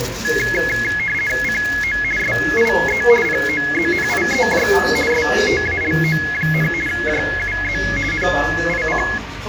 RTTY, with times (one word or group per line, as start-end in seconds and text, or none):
1.4-2.0 CO
2.2-3.0 SIE
3.2-4.7 POZNIEJ
5.1-6.7 STALO,
6.9-7.8 JUZ
8.1-9.0 NIC